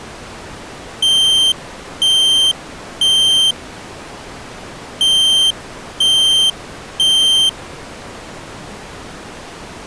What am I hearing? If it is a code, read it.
Alarm pattern, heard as an alarm's beeps, played twice, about 3150 Hz. Temporal three. Smoke or fire, evacuate.